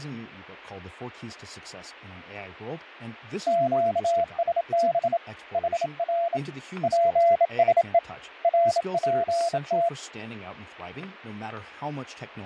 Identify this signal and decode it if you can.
Morse code, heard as a keyed tone, hand-sent with a bug key, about 27 wpm, 680 Hz, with fading, static crashes and speech in English. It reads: QSB HR PSE RPT